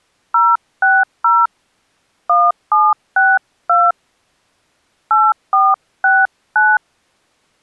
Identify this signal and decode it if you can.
DTMF, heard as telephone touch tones, dialled by hand, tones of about 210 ms. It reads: 060 1762 8469